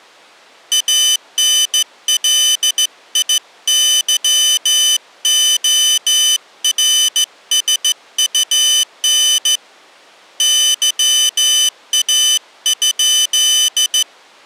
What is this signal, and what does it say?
Morse code, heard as a high beeper, hand-sent with a straight key, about 15 wpm, 3000 Hz. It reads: ANLIYORSUN YA?